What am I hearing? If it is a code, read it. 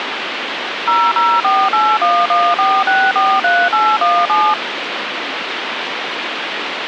DTMF, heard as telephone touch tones, dialled by machine, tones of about 240 ms, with phone line noise. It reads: 0048114643817